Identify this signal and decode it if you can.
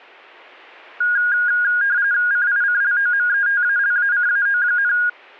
RTTY (45.45 baud, 170 Hz shift), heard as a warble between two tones, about 1550 Hz centre. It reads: CICLOMETALACAO,